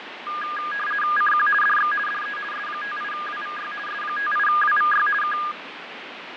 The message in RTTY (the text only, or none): CQ DX DE S58WVY S58WVY K